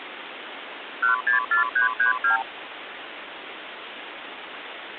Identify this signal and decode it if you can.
Multi-frequency trunk signalling (R2, with the far end's replies), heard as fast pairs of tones, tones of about 120 ms, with phone line noise. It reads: 164332